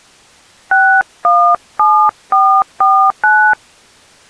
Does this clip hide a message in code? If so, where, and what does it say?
Yes: DTMF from 0.7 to 3.5 s, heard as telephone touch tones, dialled by hand, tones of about 300 ms. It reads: 617449